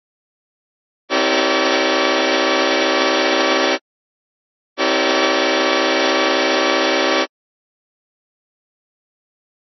Train horn signal, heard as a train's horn. 2 long. On North American railways: brakes released, proceed.